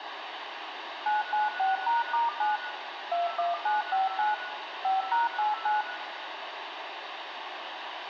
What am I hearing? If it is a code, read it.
DTMF, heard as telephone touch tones, dialled by machine, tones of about 160 ms, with phone line noise and room echo. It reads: 996#*9 21959 5#89